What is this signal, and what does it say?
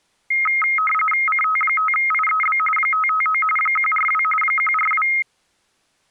RTTY (45.45 baud, 850 Hz shift), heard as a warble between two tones, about 1700 Hz centre. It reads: CT5IEB 559 142 142